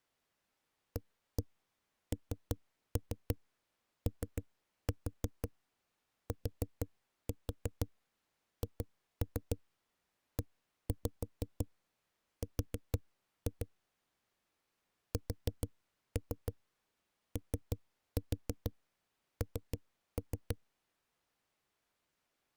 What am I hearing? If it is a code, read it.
Tap code, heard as knocks on a wall, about 6 knocks a second. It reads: ANOTHER SON